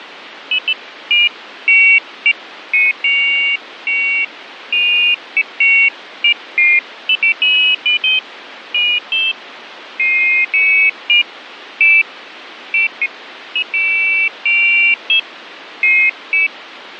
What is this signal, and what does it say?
Pairs of high tones at irregular times, with radio static. There is no code.